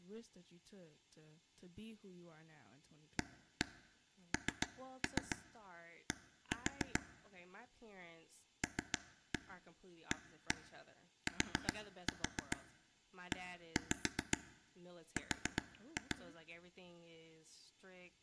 Tap code, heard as taps on a table, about 7 knocks a second, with speech in English. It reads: AND LATER